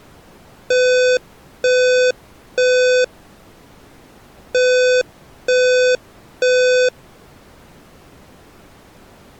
Alarm pattern, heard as an alarm's beeps, played twice, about 500 Hz. Temporal three. Smoke or fire, evacuate.